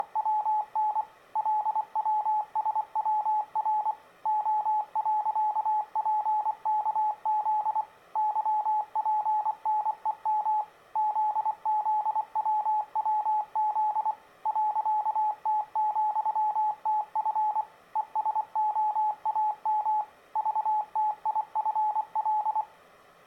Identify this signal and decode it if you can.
Morse code, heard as a keyed tone, machine-sent, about 24 wpm, 850 Hz. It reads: … LWSWR O.PKZ YPNEM ZZWWZ .T,TF ESOAM VTIFL